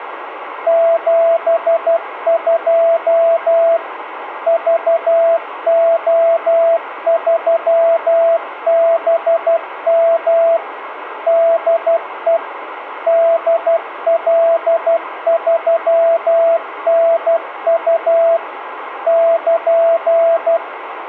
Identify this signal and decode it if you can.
Morse code, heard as a keyed tone, machine-sent, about 12 wpm, 670 Hz, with radio static. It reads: 72 VO3BM DE DL3NU <KN>